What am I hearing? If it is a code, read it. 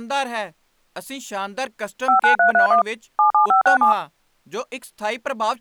DTMF, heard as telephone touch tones, dialled by machine, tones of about 110 ms, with speech in Punjabi. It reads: 59331 77567